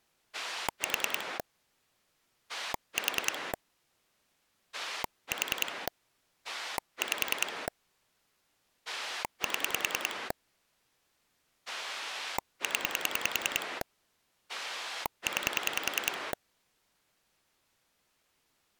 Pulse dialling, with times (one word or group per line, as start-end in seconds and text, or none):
0.3-1.4 4
2.5-3.5 4
4.7-5.9 4
6.4-7.7 5
8.9-10.3 7
11.7-13.8 0
14.5-16.3 9